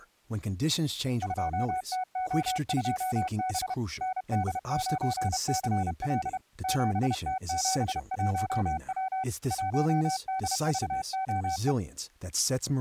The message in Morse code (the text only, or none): 2TO2B ND9CL 7T71W 1DVOE